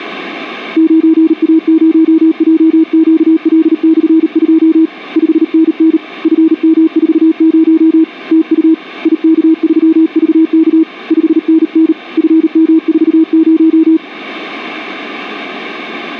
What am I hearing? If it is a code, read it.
Morse code, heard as a keyed tone, hand-sent with a paddle, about 38 wpm, 320 Hz. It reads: 9A0JQL/2 5NN FM40 TU IK3VK 5NN FM40